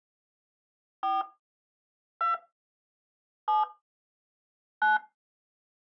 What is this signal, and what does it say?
DTMF, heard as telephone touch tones, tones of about 170 ms. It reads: 4 2 7 9